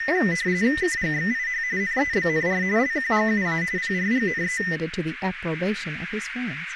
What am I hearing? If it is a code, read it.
RTTY (45.45 baud, 170 Hz shift), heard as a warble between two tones, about 1900 Hz centre, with radio static, a narrow filter and speech in English. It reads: KGXIH NEBNR LQGUA PRGNE